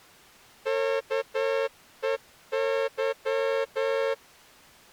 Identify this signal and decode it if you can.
Morse code, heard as a horn, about 10 wpm. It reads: KEY